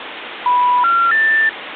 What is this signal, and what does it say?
Telephone call progress tone (North American plan), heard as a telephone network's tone, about 980, 1370, 1800 Hz, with phone line noise. Special information tone.